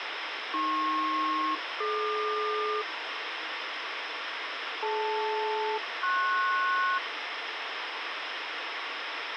Aircraft SELCAL, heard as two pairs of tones, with radio hiss and a squelch burst at the end. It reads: AP-DQ DL-PS